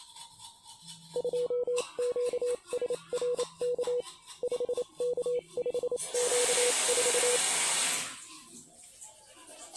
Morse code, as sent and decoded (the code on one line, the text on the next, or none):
..--- --.- ... .-. -.- / ..... -.- ..... --.- ....-
2QSRK 5K5Q4